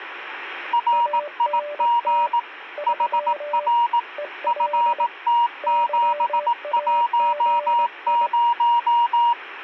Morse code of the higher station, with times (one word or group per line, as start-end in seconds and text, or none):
0.7-2.4 RIG
2.9-4.0 HR
4.5-9.3 FT710